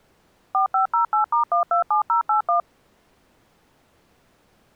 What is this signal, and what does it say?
DTMF, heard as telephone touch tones, dialled by machine, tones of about 120 ms. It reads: 4508*127081